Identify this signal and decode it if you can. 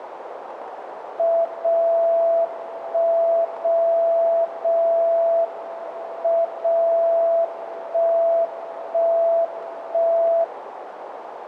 Radio time signal (WWVB), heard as a tone whose level steps once a second, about 670 Hz, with radio static and a narrow filter. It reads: 0 1 0 0 M 0 1 1 1